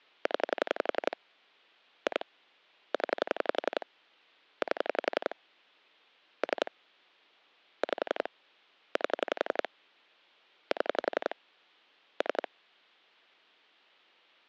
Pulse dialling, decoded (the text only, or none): 0 2 0 8 3 5 8 7 3